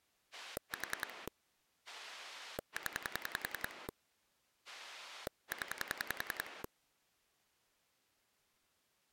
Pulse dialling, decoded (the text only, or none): 4 0 0